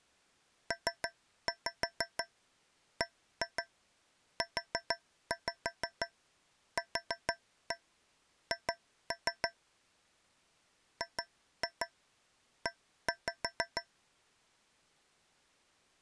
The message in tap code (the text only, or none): PBUQH GE